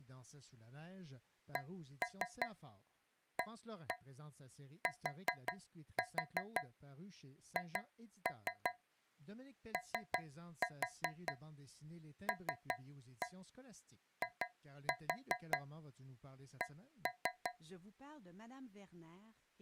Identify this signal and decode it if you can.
Tap code, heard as taps on a metal pipe, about 5 knocks a second, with speech in French. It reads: CATHOLIC